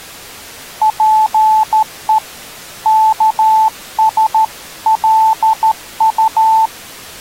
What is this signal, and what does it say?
Morse code (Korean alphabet), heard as a keyed tone, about 13 wpm, 880 Hz. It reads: 자 여기